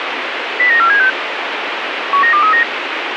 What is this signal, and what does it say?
Five-tone selective call (CCIR), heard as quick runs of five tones, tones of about 100 ms, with radio hiss. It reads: 09476 19239